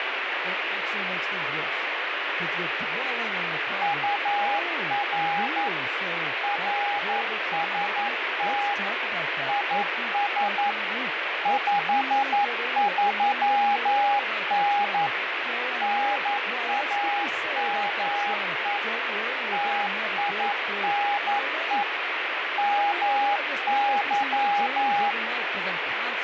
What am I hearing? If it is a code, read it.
Morse code, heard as a keyed tone, machine-sent, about 11 wpm, 820 Hz, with heavy radio static, fading and speech in English. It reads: UR RST IS 53N NAME TINE MY